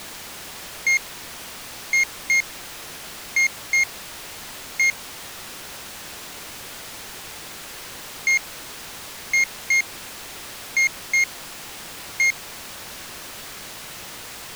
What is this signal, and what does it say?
Beep code, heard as a piezo beeper, played twice, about 2150 Hz. 1-2-2-1.